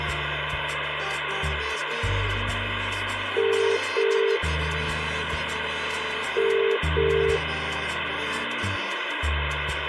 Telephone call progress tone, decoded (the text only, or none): ringback tone